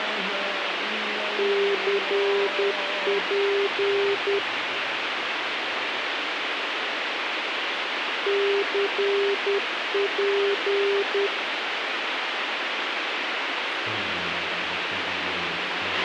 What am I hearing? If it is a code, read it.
Morse code, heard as a keyed tone, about 10 wpm, 400 Hz, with radio hiss and a squelch burst at the end. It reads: CP CP